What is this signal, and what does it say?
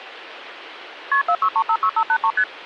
Multi-frequency trunk signalling (R1, as on North American trunks), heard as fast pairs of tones, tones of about 70 ms, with phone line noise. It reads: KP 46356583 ST